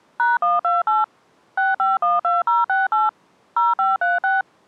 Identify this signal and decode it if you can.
DTMF, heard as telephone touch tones, dialled by machine, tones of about 170 ms. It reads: #128 6512068 0536